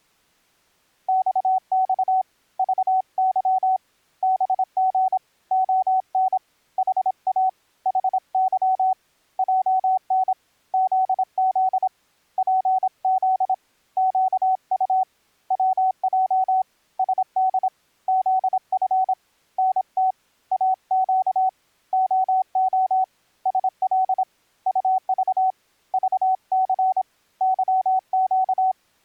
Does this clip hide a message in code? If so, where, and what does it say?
Yes: Morse code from 1.0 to 28.8 s, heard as a keyed tone, hand-sent with a paddle, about 26 wpm, 750 Hz. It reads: XX VY BG ON HA HY JN ZZ PZ QU WJ SD ZF NT AQ OO SL UV VC YQ